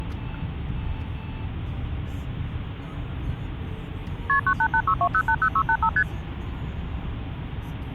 Multi-frequency trunk signalling (R1, as on North American trunks), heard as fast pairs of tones, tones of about 70 ms, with the noise inside a car. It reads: KP 98862080685 ST